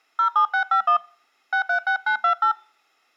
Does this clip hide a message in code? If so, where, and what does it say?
Yes: DTMF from 0.2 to 2.5 s, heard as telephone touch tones, dialled by hand, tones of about 100 ms. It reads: 07651 636928